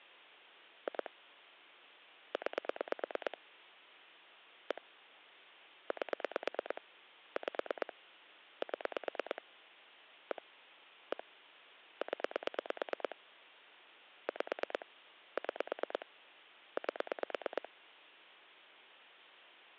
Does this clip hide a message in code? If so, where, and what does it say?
Yes: pulse dialling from 0.9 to 17.7 s, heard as clicks on a phone line, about 9 pulses a second. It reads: 2 9 1 8 5 7 1 1 0 5 6 8